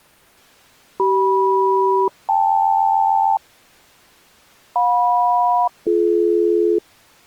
Aircraft SELCAL, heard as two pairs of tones. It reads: CM-KL JM-BD